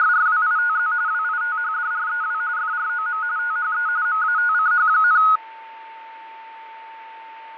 RTTY (45.45 baud, 170 Hz shift), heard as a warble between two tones, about 1360 Hz centre, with fading and a steady whistle near 900 Hz. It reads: … WITHDREW FROM THE MATCH,